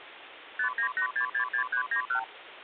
Multi-frequency trunk signalling (R2, with the far end's replies), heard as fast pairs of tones, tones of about 90 ms, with phone line noise. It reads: 598666391